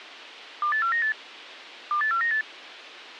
Five-tone selective call (CCIR), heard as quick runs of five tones, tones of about 100 ms. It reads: 28498 28498